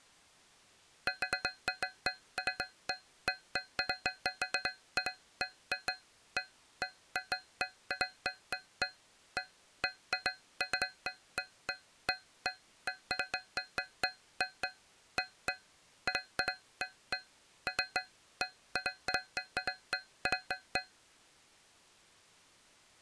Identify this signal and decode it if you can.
Irregular taps on a metal pipe. There is no code.